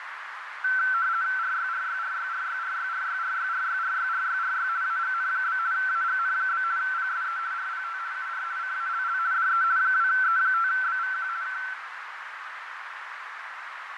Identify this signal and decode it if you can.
RTTY (50 baud, 170 Hz shift), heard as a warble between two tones, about 1440 Hz centre, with radio static, fading and a narrow filter. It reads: RYRYRYRYRYRYRYRYRYRYRY AGN? AGN? PSE RPT UR CALL DE 2E5BVQ K